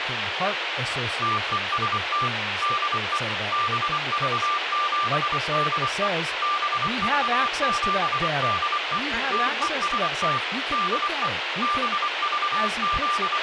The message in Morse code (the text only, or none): TEST DE BV7DE BV7DE TEST DE …